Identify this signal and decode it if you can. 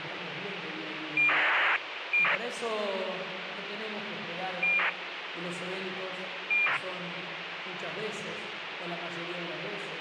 ACARS aircraft data, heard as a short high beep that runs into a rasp, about 2400 baud, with radio hiss.